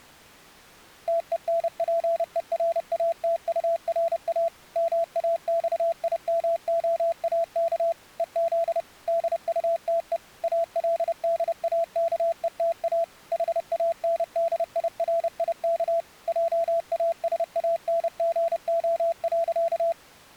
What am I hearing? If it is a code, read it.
Morse code, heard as a keyed tone, machine-sent, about 30 wpm, 670 Hz. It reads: TENPERATURA MAXIMOAK EZ DUTE ALDAKETA HANDIRIK JASANGO.